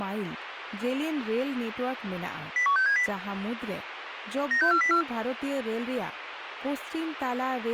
Five-tone selective call (CCIR), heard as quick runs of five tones, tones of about 100 ms, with radio hiss and speech in Santali. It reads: 01670 96404